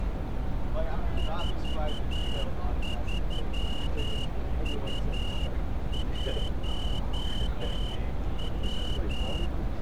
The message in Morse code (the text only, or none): 43U1W